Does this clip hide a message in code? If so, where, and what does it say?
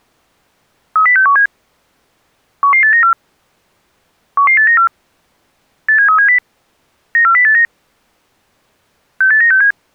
Yes: five-tone selective call (CCIR) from 1.0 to 9.7 s, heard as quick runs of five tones, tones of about 100 ms. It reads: 30617 11894 11894 87370 94089 68967